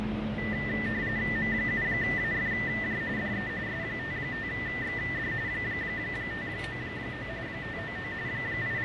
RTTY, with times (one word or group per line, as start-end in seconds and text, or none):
1.4-3.0 M7AFJ
3.2-3.5 DE
3.7-5.3 S55XD
5.5-7.3 599
7.5-8.1 599
8.3-8.8 …